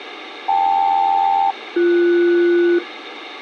Aircraft SELCAL, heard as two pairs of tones, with radio hiss and a squelch burst at the end. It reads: KL-BS